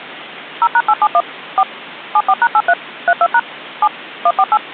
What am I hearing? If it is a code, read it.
DTMF, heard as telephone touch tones, dialled by machine, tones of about 50 ms. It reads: 0#871 4 74#83 32# 7 148